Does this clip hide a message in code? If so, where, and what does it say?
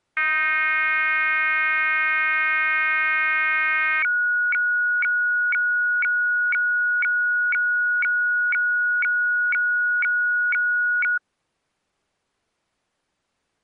Yes: weather fax (radiofax), 120 lines a minute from 0.2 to 11.2 s, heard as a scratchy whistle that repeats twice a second.